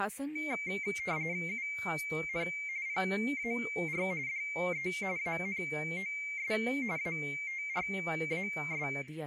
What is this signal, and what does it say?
RTTY (45.45 baud, 170 Hz shift), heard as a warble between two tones, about 2200 Hz centre, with speech in Urdu. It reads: UN PAR DE ANOS ATRAS